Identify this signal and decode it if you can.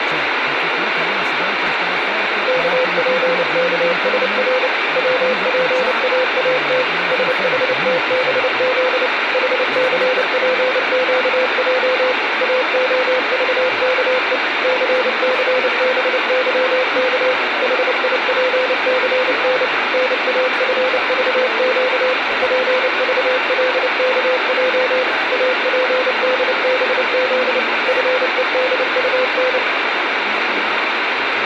Morse code, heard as a keyed tone, machine-sent, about 29 wpm, 510 Hz, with radio static. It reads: KPKSR WPAAT SHTBZ HCPQJ AOVKE CCBYK HIPCN NAFVQ PVLKJ APDBZ FEDUN